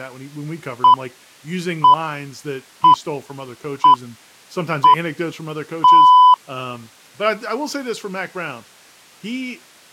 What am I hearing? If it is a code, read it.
Radio time signal (six pips, as the Greenwich Time Signal), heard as pips, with speech in English.